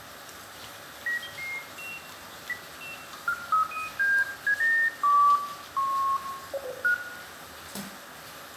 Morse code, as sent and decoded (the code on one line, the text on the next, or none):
none